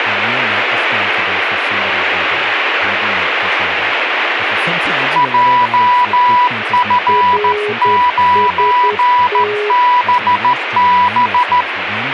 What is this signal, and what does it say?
Morse code, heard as two keyed tones, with radio static and speech in English. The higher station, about 14 wpm, 980 Hz: JF9BB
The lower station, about 10 wpm, 420 Hz: RST